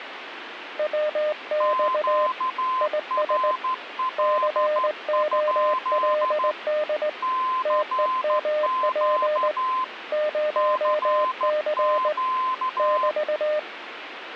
Morse code, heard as two keyed tones, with radio static. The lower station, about 18 wpm, 610 Hz: WX IS COLD TEMP 0C <BT>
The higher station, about 13 wpm, 1030 Hz: QRL? CQ CQ